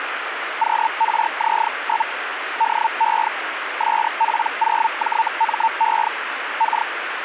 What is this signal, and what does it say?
Hellschreiber (Feld-Hell, 122.5 baud), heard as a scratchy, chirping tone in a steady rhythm, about 900 Hz, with radio static. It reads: QRZ? DE SP0JME K